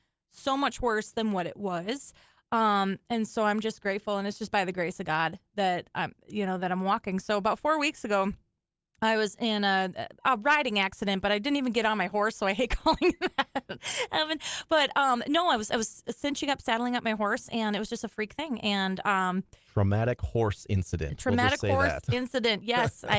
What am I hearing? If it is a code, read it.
Speech in English. There is no code.